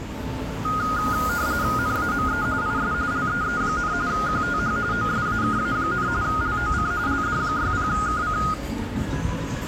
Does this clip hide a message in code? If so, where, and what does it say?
Yes: RTTY (45.45 baud, 170 Hz shift) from 0.6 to 8.5 s, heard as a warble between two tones, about 1340 Hz centre, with street noise. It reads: NAME IS LEE, QTH OSAKA, LOC LD60KC